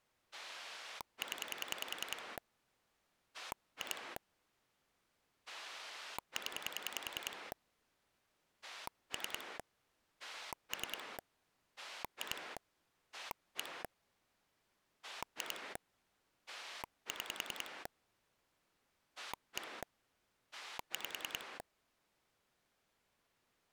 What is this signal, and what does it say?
Pulse dialling, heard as a rotary dial, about 10 pulses a second. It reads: 0 2 0 3 3 2 1 2 6 1 5